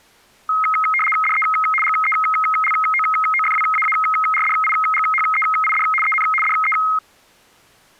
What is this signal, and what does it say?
RTTY (75 baud, 850 Hz shift), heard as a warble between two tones, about 1700 Hz centre. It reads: DE GELOOFWAARDIGHEID EN DE